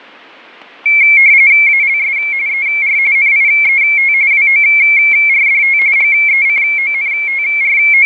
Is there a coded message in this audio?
Yes: RTTY (45.45 baud, 170 Hz shift) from 0.9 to 8.1 s, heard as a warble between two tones, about 2250 Hz centre, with fading and static crashes. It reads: ALS ER NIET WORDT …